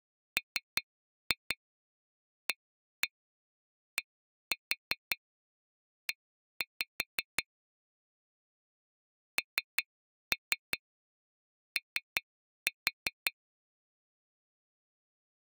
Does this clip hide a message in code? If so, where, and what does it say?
Yes: tap code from 0.4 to 13.3 s, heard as taps on glass, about 5 knocks a second. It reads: MADE NO